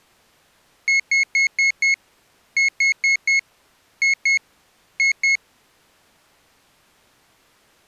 Beep code, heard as a piezo beeper, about 2150 Hz. 5-4-2-2.